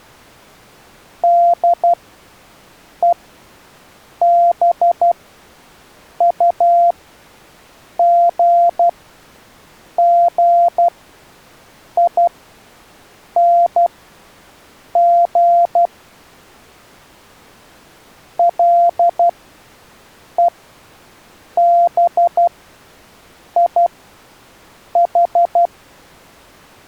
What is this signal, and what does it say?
Morse code, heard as a keyed tone, machine-sent, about 12 wpm, spaced as for 6 wpm, 690 Hz. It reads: DEBUGGING LEBIH